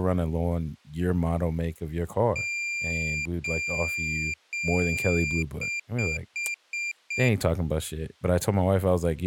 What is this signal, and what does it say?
Beep code, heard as a piezo beeper, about 2400 Hz, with speech in English. 3 long, 5 short.